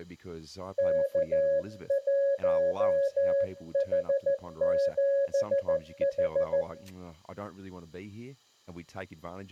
Morse code, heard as a keyed tone, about 14 wpm, 560 Hz, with room echo and speech in English. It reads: K1H7H